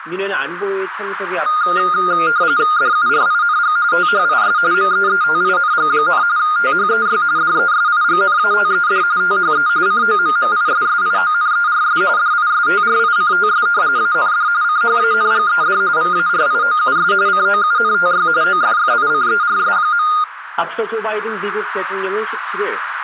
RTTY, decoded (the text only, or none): DURING THIS MEETING, THEY DESIGNATED THE COMMISSIONERS DISTRICTS AND CHANGED VARIOUS COUNTY OFFICERS.